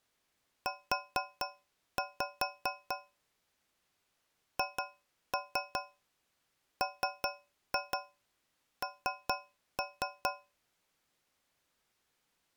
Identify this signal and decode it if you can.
Tap code, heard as taps on a metal pipe, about 4 knocks a second. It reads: U HMN